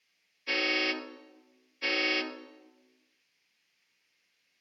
Train horn signal, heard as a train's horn, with room echo. 2 short. On North American railways: a signal is acknowledged.